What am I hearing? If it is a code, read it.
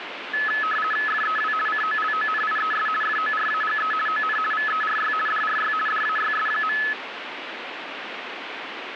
RTTY (50 baud, 450 Hz shift), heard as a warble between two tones, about 1500 Hz centre, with radio static. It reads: FEW COLONIES FORAGE ON VERY DRY DAYS.